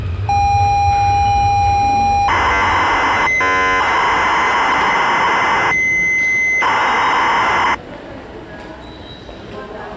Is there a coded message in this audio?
Yes: ZX Spectrum tape loading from 0.3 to 7.7 s, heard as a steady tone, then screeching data, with the noise of a subway station.